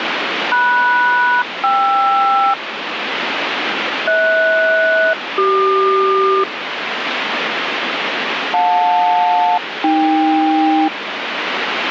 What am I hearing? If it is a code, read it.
Aircraft SELCAL, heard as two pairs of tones, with radio static. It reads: MS-KR HS-CQ JL-AK